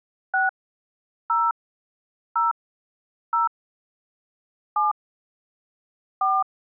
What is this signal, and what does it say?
DTMF, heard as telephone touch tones, dialled by hand, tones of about 160 ms. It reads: 6 0 0 0 7 4